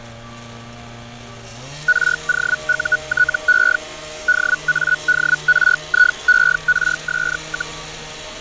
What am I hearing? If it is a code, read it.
Hellschreiber (Feld-Hell, 122.5 baud), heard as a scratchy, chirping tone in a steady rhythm, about 1470 Hz, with fading, static crashes and street noise. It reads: ROUTE DADRIERS,